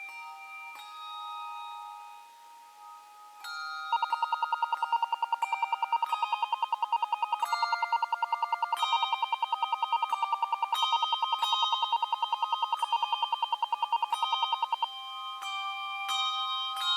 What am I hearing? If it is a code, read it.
Radio time signal (RWM, Moscow), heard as ten pulses a second.